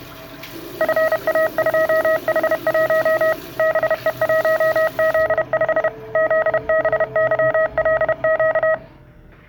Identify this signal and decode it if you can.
Morse code, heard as a keyed tone, machine-sent, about 31 wpm, 640 Hz, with the noise of a restroom. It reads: FA2H1 BE1Z5 ZBYLQ